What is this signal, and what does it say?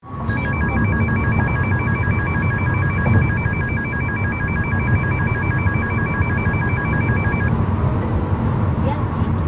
A tone that alternates evenly between two pitches, with the noise inside a car. There is no code.